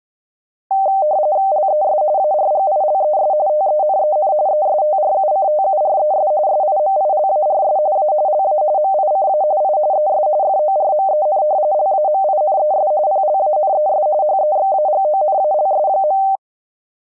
RTTY (45.45 baud, 170 Hz shift), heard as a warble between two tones, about 690 Hz centre. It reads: LES ARGILES TENEN ESTRUCTURES SIMILARS A LA MICA I ES FORMEN LAMINES PLANES HEXAGONALS.